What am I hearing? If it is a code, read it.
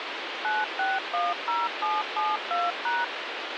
DTMF, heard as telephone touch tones, dialled by machine, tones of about 200 ms, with phone line noise. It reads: 9610772#